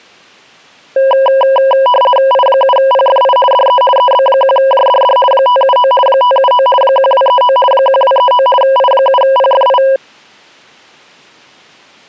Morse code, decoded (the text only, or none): none